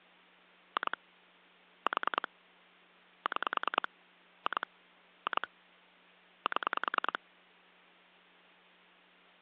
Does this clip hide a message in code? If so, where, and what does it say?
Yes: pulse dialling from 0.8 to 7.2 s, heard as clicks on a phone line, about 10 pulses a second, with hum. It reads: 2 4 6 2 2 7